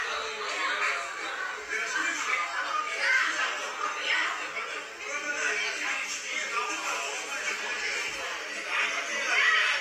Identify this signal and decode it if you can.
The noise of a crowd indoors. There is no code.